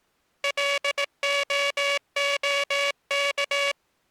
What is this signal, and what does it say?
Morse code, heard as a buzzer, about 18 wpm. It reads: LOOK